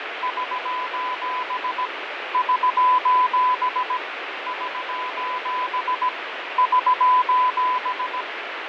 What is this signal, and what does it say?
Morse code, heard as a keyed tone, machine-sent, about 17 wpm, 1000 Hz, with radio static and fading. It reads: <SOS> <SOS> <SOS> <SOS>